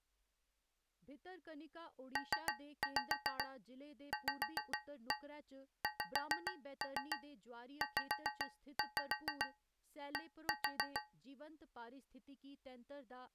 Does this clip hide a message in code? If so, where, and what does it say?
Yes: tap code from 2.2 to 11.2 s, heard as taps on a metal pipe, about 6 knocks a second, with speech in Dogri. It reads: PVXZD